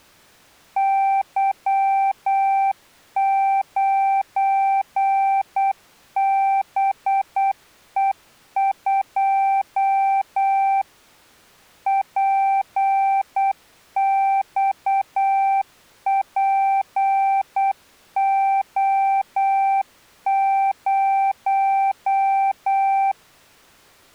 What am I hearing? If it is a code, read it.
Morse code, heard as a keyed tone, machine-sent, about 8 wpm, 780 Hz. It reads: Y9BE2 PXPO0